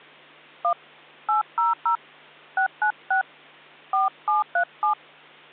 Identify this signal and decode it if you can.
DTMF, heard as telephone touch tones, dialled by hand, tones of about 120 ms, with hum. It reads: 1 800 696 4737